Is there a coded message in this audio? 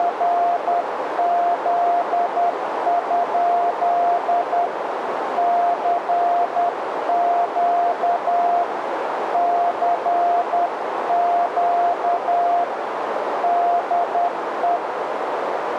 Yes: Morse code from 0.0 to 14.8 s, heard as a keyed tone, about 10 wpm, 700 Hz, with radio static and a narrow filter. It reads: … CQ CQ DE